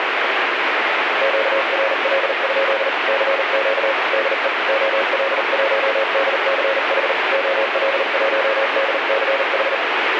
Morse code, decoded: QRL? CQ DE OL1DCH OL1DCH

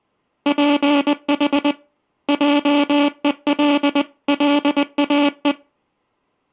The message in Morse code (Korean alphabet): 주 학과

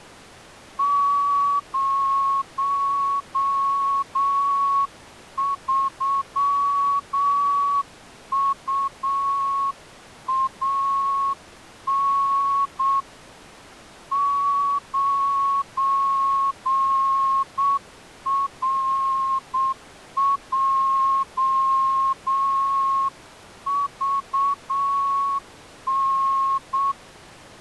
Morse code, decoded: 03UAN 9RJVN

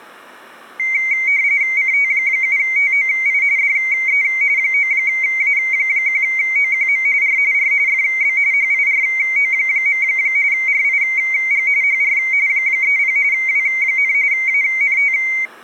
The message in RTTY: CT7TOI DE 9A1OQM R R FB HIRO. RIG HR 30 W, ANT

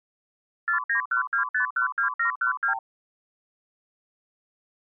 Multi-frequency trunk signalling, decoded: 4912512712

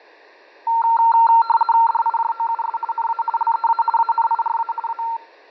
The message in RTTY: DIJOUS NA LEA ANIRA A

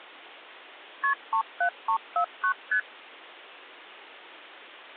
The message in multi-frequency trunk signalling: KP 37349 ST

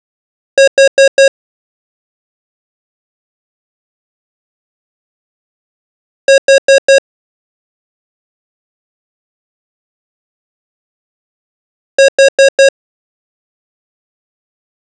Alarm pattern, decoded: temporal four

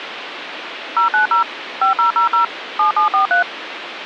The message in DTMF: 090 5000 7743

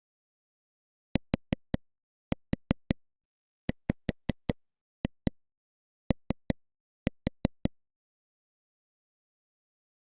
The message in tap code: TWO

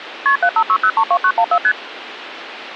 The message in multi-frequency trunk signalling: KP 756032914 ST

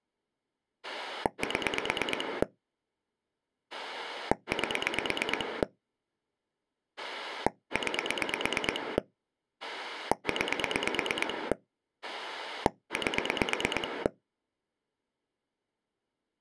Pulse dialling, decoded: 7 8 9 9 8

